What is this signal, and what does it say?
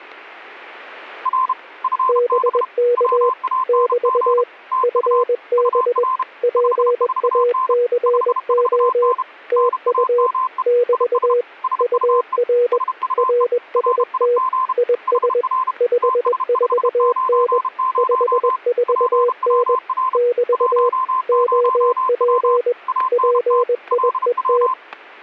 Morse code, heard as two keyed tones, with static crashes. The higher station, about 32 wpm, 1040 Hz: R FB WANG TU UR 54N 54N NAME IS SUE SUE RIG HR TS590 PWR 10W ANT LW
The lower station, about 21 wpm, 480 Hz: BK <BT> FB PACO TU <BT> UR RST IS 54N 54N <BT> OP PIET